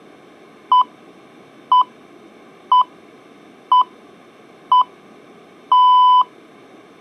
Radio time signal (six pips, as the Greenwich Time Signal), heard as pips.